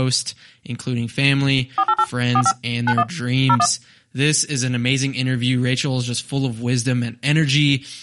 DTMF, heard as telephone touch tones, dialled by machine, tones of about 60 ms, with speech in English. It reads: 488 45 91 01